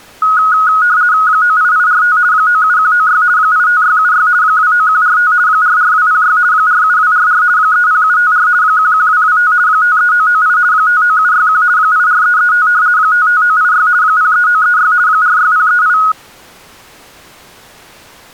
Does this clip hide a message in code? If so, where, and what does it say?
Yes: RTTY (50 baud, 170 Hz shift) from 0.2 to 16.1 s, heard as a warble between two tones, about 1360 Hz centre. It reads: 98845 97196 85676 29145 44206 47244 30754 11225 53998 59761 84335 55986 03936 46038